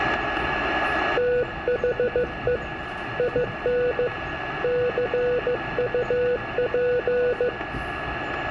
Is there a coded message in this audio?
Yes: Morse code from 1.1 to 7.5 s, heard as a keyed tone, hand-sent with a paddle, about 15 wpm, 490 Hz, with radio static, a steady whistle near 1690 Hz, room echo and the noise inside a subway train. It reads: THE IN CUP